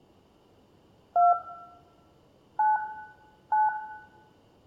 DTMF, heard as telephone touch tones, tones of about 170 ms, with room echo. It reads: 2 9 9